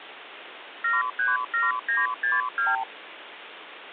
Multi-frequency trunk signalling (R2, with the far end's replies), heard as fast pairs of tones, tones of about 170 ms, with phone line noise. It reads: 737962